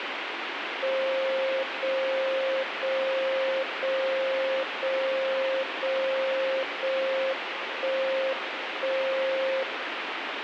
Radio time signal (JJY), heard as a tone whose level steps once a second, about 530 Hz, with radio static. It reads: 0 0 0 0 0 0 1 1 0